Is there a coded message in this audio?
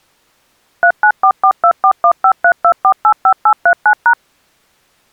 Yes: DTMF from 0.8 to 4.1 s, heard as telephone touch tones, dialled by machine, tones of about 80 ms. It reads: 3944241532485839#